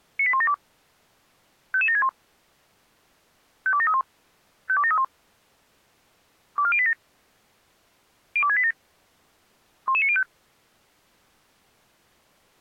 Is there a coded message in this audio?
Yes: five-tone selective call (ZVEI) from 0.2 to 10.2 s, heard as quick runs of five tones, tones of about 70 ms. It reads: 98172 55761 52731 52731 24087 02687 11905